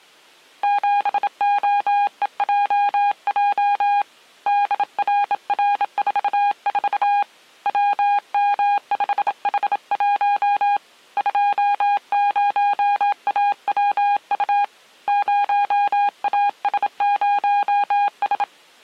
Morse code, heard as a keyed tone, hand-sent with a bug key, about 27 wpm, 810 Hz. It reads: 7OEJJ DRR44 WM5H1 20AWU 0AS0S